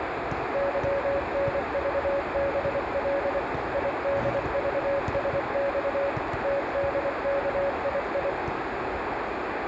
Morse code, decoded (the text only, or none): YNVBL IDVSX TDKII